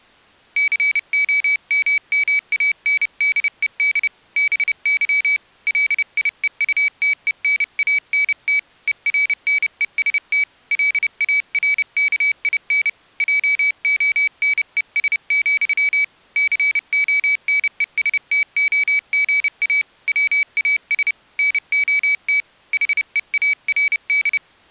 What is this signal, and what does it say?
Morse code, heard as a high beeper, hand-sent with a paddle, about 30 wpm, 2300 Hz. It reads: COMMANDED BY LIEUTENANT ERNEST LARKIN JONES, CONESTOGA WAS NOT HEARD